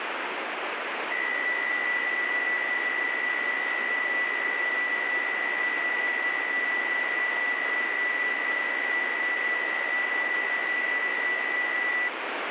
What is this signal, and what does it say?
PSK63 (62.5 baud), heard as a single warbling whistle, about 1950 Hz, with radio static.